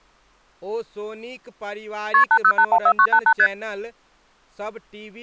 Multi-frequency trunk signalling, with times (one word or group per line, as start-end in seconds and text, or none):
2.1-2.2 KP
2.3-3.3 80814988
3.4-3.5 ST